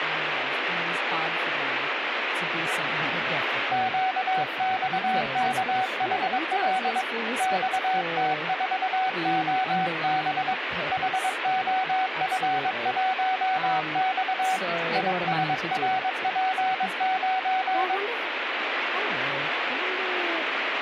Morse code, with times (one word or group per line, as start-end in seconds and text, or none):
3.7-7.0 QXKHL
7.4-10.5 XT4OB
10.9-14.6 HOF1X
15.0-18.0 ISRP9